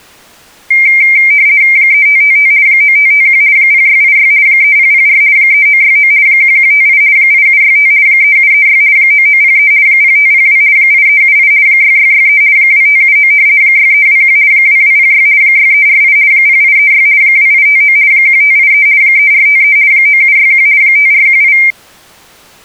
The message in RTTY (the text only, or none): 3555 9551 0686 3004 3969 1158 8765 3736 9903 0502 8378 6663 2579 6321 2206 6348 0836 2859 1583 3453 9761 5418